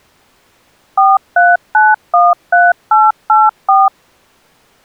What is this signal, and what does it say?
DTMF, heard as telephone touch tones, dialled by machine, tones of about 200 ms. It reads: 43913884